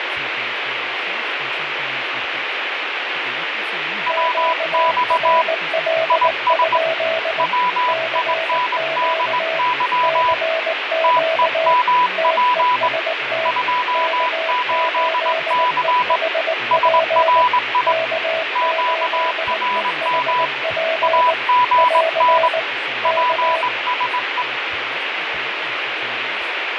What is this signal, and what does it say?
Morse code, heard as two keyed tones, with radio static. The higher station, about 20 wpm, 990 Hz: WX IS WINDY TEMP 28C SRI QRM AGN PSE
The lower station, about 19 wpm, 650 Hz: QRL? CQ CQ TEST K8EHP K8EHP <AR> K